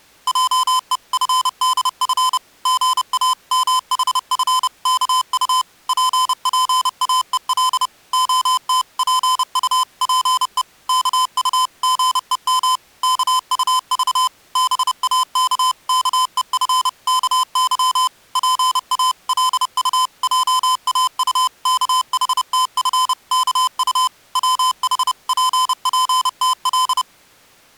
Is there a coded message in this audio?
Yes: Morse code (Korean alphabet) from 0.2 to 27.1 s, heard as electronic beeps, machine-sent, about 30 wpm, 1020 Hz. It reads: 하는 소문이 쫙 퍼지자 이삼 일 동안에 조기회원이 부쩍